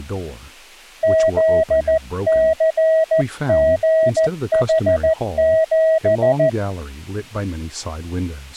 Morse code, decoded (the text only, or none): ZCGH7